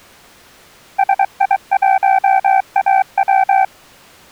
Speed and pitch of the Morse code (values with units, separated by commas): 23 wpm, 770 Hz